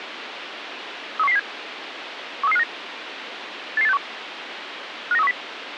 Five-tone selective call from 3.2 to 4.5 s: 88861

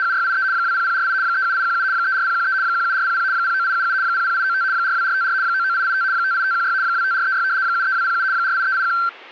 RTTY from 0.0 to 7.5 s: … 20048 37817 34013 17400 09877 00895 42454 99885 58516 25436

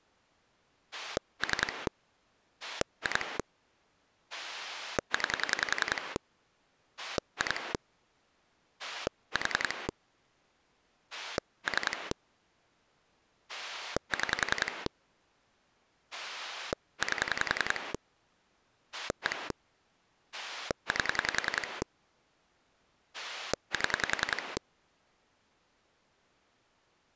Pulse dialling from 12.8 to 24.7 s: 6 8 1 8 7

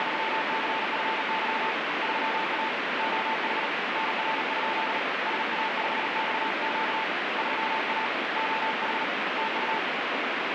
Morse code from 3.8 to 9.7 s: NR? SA5XQ 3A OH TU

